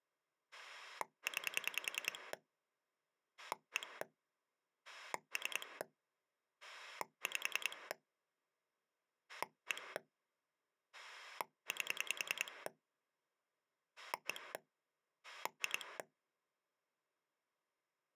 Pulse dialling, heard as a rotary dial, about 10 pulses a second. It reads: 9 1 3 5 1 8 1 2